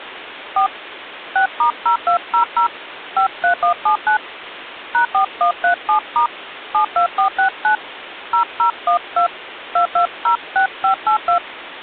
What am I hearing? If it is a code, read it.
DTMF, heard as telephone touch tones, dialled by hand, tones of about 100 ms, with phone line noise. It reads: 4 6*0200 53179 #4137* 72469 0012 2206582